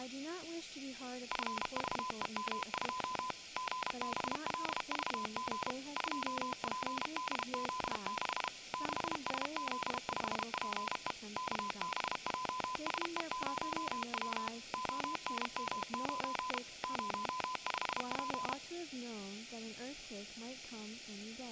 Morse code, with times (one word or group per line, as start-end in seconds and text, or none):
1.3-3.3 FVEM2
3.6-5.7 GBLVG
6.0-8.5 2PDZ6
8.7-11.1 6SZ5PE
11.4-14.5 KBJSE0W
14.7-16.6 ONM9
16.8-18.5 05P